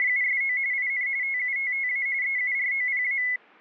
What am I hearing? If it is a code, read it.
RTTY (45.45 baud, 170 Hz shift), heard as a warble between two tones, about 2100 Hz centre. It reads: … IN TUTTA EUROPA